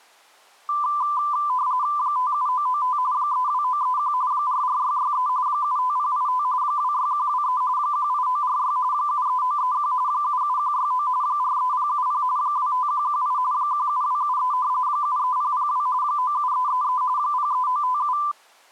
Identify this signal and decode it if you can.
RTTY (45.45 baud, 170 Hz shift), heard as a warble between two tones, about 1090 Hz centre. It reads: 57995 32931 44663 75085 26123 18946 73931 77169 43070 25118 17273 73002 97333 03957